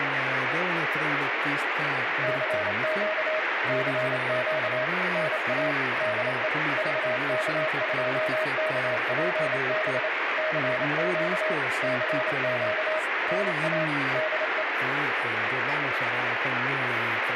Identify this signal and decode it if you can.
Morse code, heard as a keyed tone, machine-sent, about 28 wpm, 630 Hz, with radio static. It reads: CQ CQ NA DE VK2KPB CQ CQ NA DE